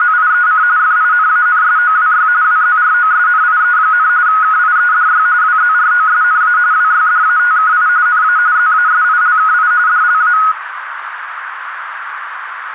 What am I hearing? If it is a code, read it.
RTTY (45.45 baud, 170 Hz shift), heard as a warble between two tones, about 1360 Hz centre, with radio static and a narrow filter. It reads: … FINANSOWY WZROSNIE, KIEDY WZROSNA WYDATKI NA ZASILKI DLA